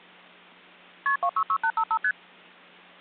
Multi-frequency trunk signalling (R1, as on North American trunks), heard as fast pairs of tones, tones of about 70 ms. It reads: KP 266855 ST